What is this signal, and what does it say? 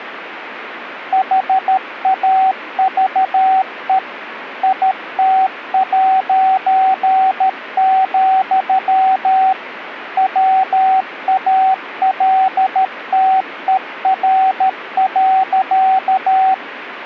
Morse code, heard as a keyed tone, machine-sent, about 13 wpm, 760 Hz, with radio static. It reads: HAVE IT', WALTER.